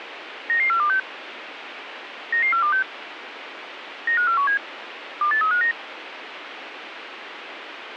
Five-tone selective call (CCIR), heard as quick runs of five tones, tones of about 100 ms, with radio hiss. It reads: 99426 99426 95417 28359